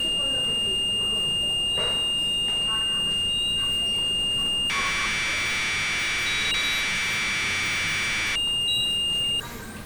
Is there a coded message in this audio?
Yes: Commodore tape loading (standard loader) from 0.0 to 9.4 s, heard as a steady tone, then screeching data, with the noise of a subway station.